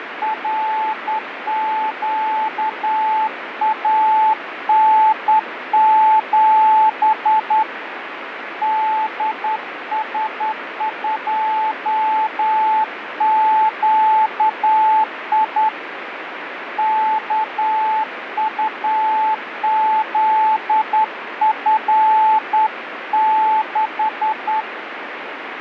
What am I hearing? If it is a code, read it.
Morse code, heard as a keyed tone, hand-sent with a straight key, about 10 wpm, 870 Hz, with radio static. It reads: RQAN7 DS2QI KUZF6